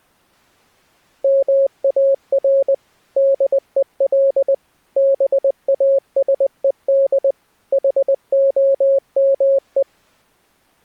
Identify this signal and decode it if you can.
Morse code, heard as a keyed tone, machine-sent, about 20 wpm, 550 Hz. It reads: MAR DEL BASED HOME